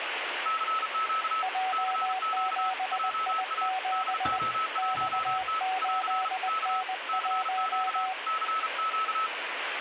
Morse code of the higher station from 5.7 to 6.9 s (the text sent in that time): <AR> K